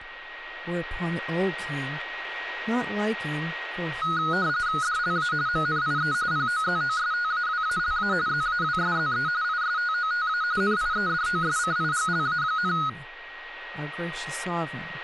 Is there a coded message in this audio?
Yes: RTTY (45.45 baud, 170 Hz shift) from 4.0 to 12.9 s, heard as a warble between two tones, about 1360 Hz centre, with a steady whistle near 1890 Hz and speech in English. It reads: DLA MNIE POZOSTAWALA ZAWSZE ISTOTA NIEDOSCIGLA,